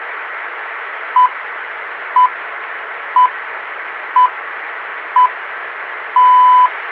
Radio time signal (six pips, as the Greenwich Time Signal), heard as pips.